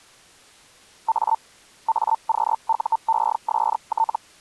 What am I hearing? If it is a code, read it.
Hellschreiber (Feld-Hell, 122.5 baud), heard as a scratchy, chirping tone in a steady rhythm, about 900 Hz. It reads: A AQUEST